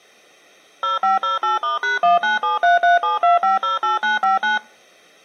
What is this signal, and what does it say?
DTMF, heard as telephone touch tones, dialled by machine, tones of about 150 ms. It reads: 0508*#1973372508959